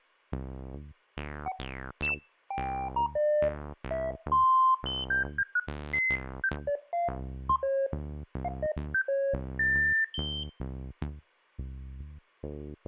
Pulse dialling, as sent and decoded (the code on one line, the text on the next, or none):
none